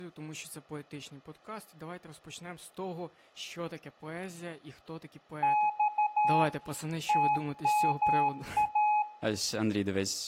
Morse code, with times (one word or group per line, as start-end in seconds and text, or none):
5.4-6.4 X
7.1-9.0 TMA